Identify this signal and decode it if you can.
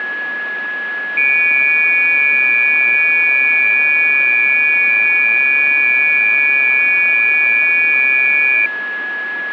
FT8 (several signals at once), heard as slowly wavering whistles, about 6.25 baud, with a steady whistle near 1690 Hz.